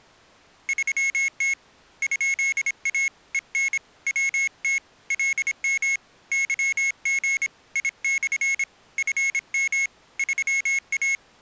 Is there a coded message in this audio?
Yes: Morse code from 0.6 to 11.2 s, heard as a high beeper, hand-sent with a paddle, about 26 wpm, 2200 Hz. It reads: 3T ?A EN WT LM YG I/ FM 3A